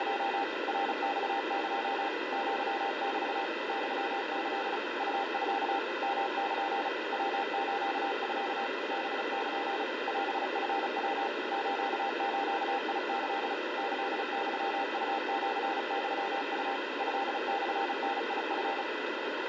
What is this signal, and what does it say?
Morse code (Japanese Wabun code), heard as a keyed tone, machine-sent, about 35 wpm, 800 Hz, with heavy radio static. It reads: … ナマエ アメ ユキ ウミ ヨル ヤスミ ハル オチヤ スズキ キユウシユウ トモダチ